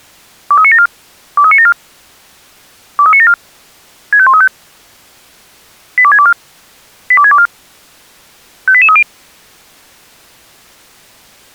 Five-tone selective call (ZVEI), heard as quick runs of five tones, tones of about 70 ms. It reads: 23974 23974 23974 65135 82624 82624 58830